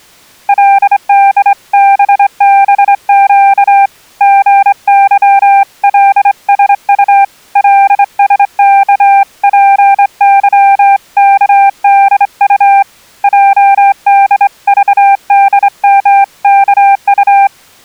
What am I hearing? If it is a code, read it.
Morse code (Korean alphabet), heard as a keyed tone, hand-sent with a straight key, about 25 wpm, 790 Hz. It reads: 그때 세계 경제의 흐름이